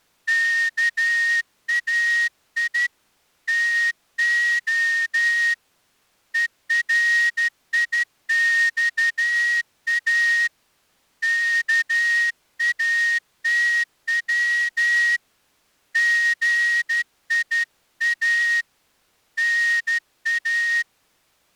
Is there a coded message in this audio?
Yes: Morse code (Greek alphabet) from 0.2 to 20.9 s, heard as a whistle, hand-sent with a straight key, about 12 wpm. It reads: ΚΑΙ ΤΟ ΕΡΙΞΑ ΚΑΤΩ ΓΙΑ ΝΑ